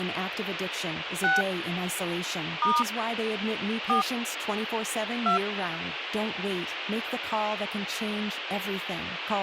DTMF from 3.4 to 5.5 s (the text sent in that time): 4 2